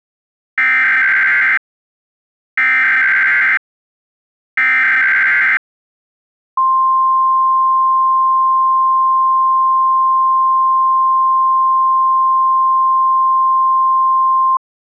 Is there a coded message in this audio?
Yes: Emergency Alert System (SAME) tones (header bursts, then the 1050 Hz attention tone) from 0.6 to 14.6 s, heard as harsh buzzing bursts, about 520.83 baud.